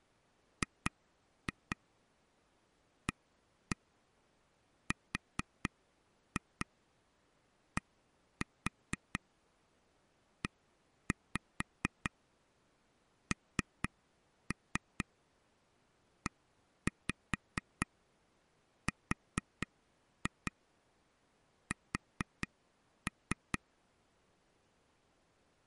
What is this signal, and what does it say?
Tap code, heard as taps on a table, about 4 knocks a second. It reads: GARDENERS